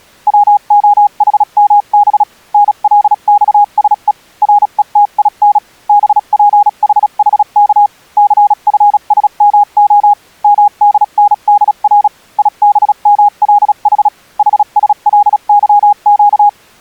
Morse code (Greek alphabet), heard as a keyed tone, machine-sent, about 36 wpm, spaced as for 32 wpm, 820 Hz. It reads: ΩΟΗΜΒ ΝΛΞΣΕ ΡΕΤΙΝ ΒΠΗΗΚ ΘΦΣΜΟ ΜΔΝΔΡ ΙΒΜΛΗ ΗΣΛΥΨ